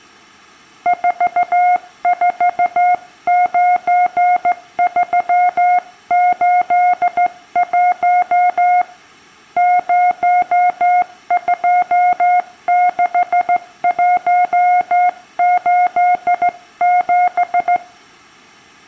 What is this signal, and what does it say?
Morse code, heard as a keyed tone, hand-sent with a straight key, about 15 wpm, 720 Hz, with room echo. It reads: 449381 026187